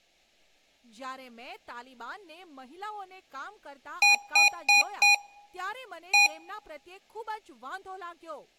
Beep code, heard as beeps from a small speaker, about 820 Hz, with room echo and speech in Gujarati. 4-1.